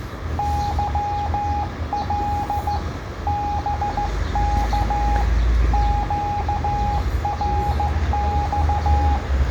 Morse code, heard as a keyed tone, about 15 wpm, 820 Hz, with the noise of a residential street. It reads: YL BK QRX